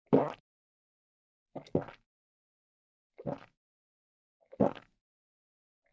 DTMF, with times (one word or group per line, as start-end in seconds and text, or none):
none